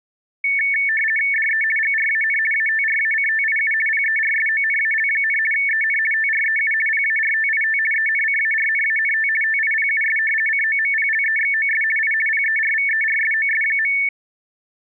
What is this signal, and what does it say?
RTTY (50 baud, 450 Hz shift), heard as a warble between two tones, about 2000 Hz centre. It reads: DE GRAN ATRACTIU PERSONAL, EN TREU PARTIT ENCARNANT TIPUS COMPLEXOS I PERVERSOS.